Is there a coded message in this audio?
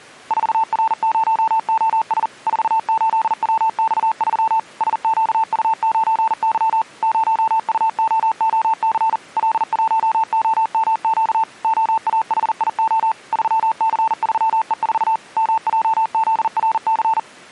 Yes: Morse code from 0.2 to 17.3 s, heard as a keyed tone, machine-sent, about 40 wpm, 890 Hz. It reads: 4R0OS 48WX3 SQU9Y 0UOOC L1OMQ OAHIO 3C3E4 MJZRC